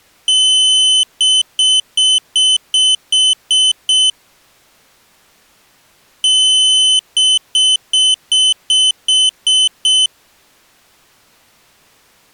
Beep code, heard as a piezo beeper, played twice, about 3050 Hz. 1 long, 8 short. In AMI BIOS tables: display or retrace test failure.